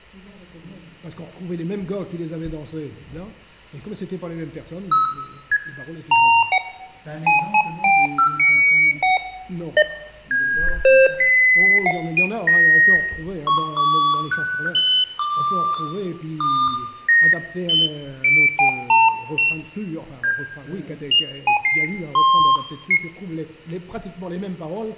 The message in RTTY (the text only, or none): none